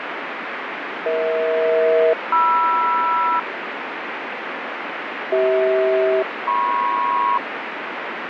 Aircraft SELCAL, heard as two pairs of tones, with radio static. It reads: EH-MR CH-MP